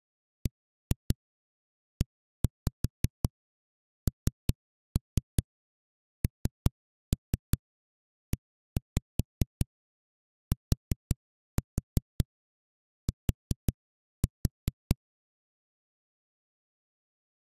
Tap code, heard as knocks on a wall, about 5 knocks a second. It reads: BENNETT